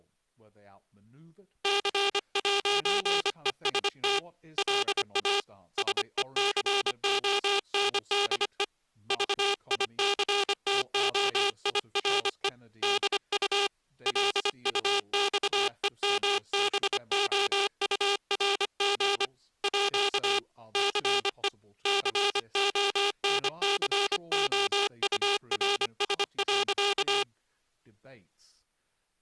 Morse code (with French letters), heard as a buzzer, hand-sent with a paddle, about 25 wpm, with speech in English. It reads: C'EST LA SECONDE VICTOIRE DU LUXEMBOURG À CE CONCOURS.